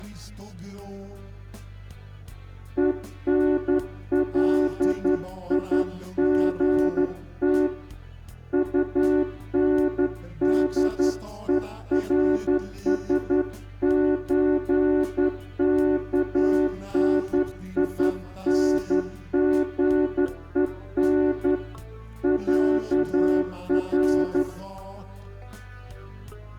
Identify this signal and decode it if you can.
Morse code (with Swedish letters), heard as a horn, hand-sent with a straight key, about 11 wpm, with room echo. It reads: ENLIGT UNDERSÖKNINGEN ÄR